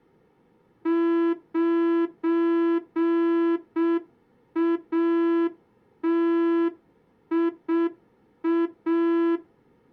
Morse code, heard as a horn, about 6 wpm. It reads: 9ATIA